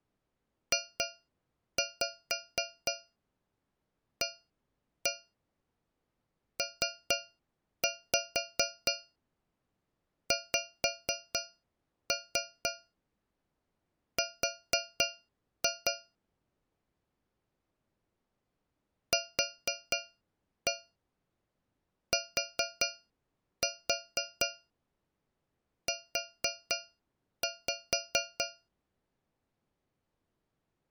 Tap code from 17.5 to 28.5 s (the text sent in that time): QTU